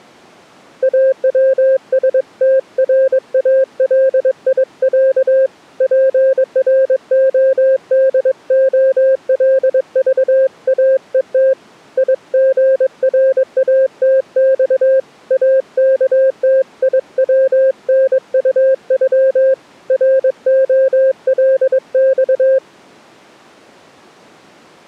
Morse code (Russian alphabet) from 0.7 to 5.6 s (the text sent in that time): АВСТРАЛИЯ